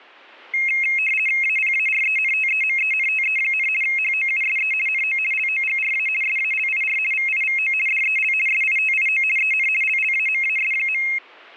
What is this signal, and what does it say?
RTTY (50 baud, 450 Hz shift), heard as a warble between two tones, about 2350 Hz centre. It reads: APARENTEMENTE, HOUSE NO LOGRA SALIR VIVO DEL SITIO EN LLAMAS.